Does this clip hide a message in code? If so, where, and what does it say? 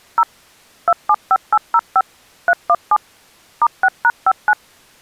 Yes: DTMF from 0.2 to 4.5 s, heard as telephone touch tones, dialled by machine, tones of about 50 ms. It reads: 0 275805 317 *6#59